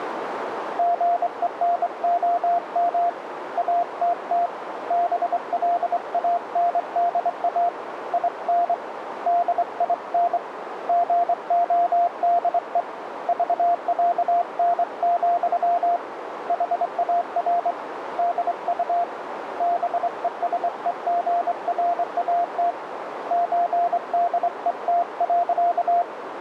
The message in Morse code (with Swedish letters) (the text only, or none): GENOM ATT BLANDA IN DIN GODE VÄN, HAR DU BESEGRAT ÖDET.